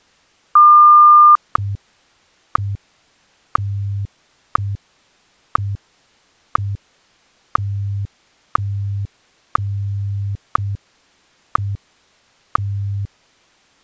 Radio time signal (WWVH, Hawaii), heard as ticks, one a second.